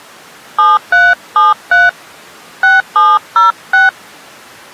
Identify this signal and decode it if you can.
DTMF, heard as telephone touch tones, dialled by hand, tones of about 200 ms. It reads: 7373 6706